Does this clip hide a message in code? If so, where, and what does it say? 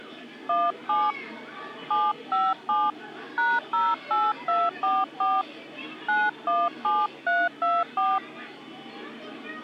Yes: DTMF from 0.5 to 8.2 s, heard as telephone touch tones, dialled by hand, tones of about 210 ms, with the noise of a park. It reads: 17 757 #08244 917324